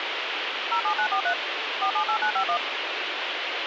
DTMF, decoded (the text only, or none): 07943 478951